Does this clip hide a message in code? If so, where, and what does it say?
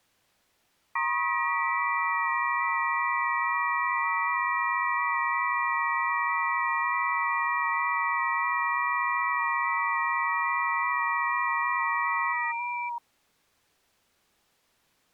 Yes: FT8 (several signals at once) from 1.0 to 13.0 s, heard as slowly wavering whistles, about 6.25 baud.